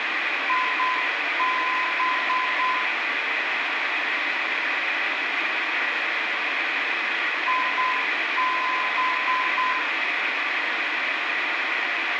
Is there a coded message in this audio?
Yes: Morse code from 0.4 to 9.8 s, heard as a keyed tone, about 8 wpm, 1020 Hz, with radio hiss and room echo. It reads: IB IB